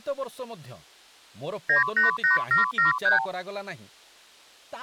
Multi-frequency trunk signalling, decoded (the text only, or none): 988773